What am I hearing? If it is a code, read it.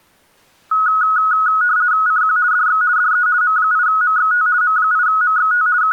RTTY (50 baud, 170 Hz shift), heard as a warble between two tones, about 1370 Hz centre. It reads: CQ DX DE M8MXT M8MXT …